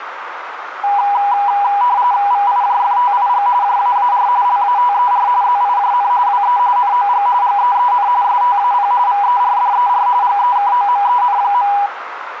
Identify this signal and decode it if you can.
RTTY (45.45 baud, 170 Hz shift), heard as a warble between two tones, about 900 Hz centre, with radio static and a narrow filter. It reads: VIJFTIG JAAR LATER ZIJN WE NOG GEEN STAP VERDER GEKOMEN.